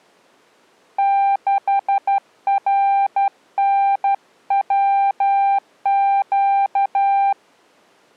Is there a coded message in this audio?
Yes: Morse code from 0.9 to 7.4 s, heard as a keyed tone, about 12 wpm, 790 Hz. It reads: 6RNWQ